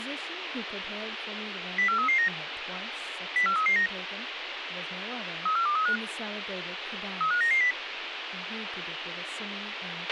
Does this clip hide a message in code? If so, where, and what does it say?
Yes: five-tone selective call (CCIR) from 1.8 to 7.7 s, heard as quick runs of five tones, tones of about 100 ms, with radio hiss, a squelch burst at the end and speech in English. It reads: 04339 04339 34235 35990